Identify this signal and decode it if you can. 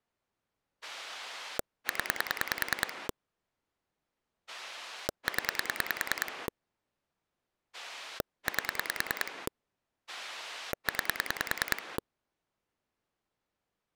Pulse dialling, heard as a rotary dial, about 10 pulses a second. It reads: 0 0 8 9